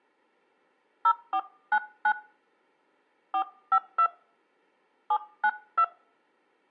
DTMF, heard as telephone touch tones, dialled by hand, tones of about 70 ms, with room echo. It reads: 0499 452 792